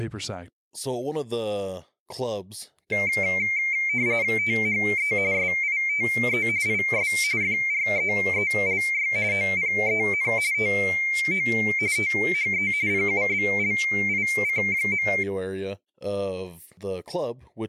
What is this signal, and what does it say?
RTTY (45.45 baud, 170 Hz shift), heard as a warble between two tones, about 2200 Hz centre, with speech in English. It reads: THE SITE IS FREELY OPEN TO THE PUBLIC.